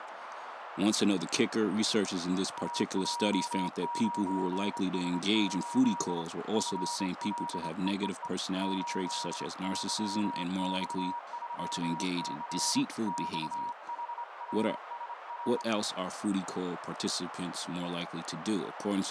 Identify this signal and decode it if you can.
Morse code, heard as a keyed tone, hand-sent with a straight key, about 26 wpm, 950 Hz, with radio static, a narrow filter and speech in English. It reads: AJ9S8 FLEEE 8YX3C XHRSR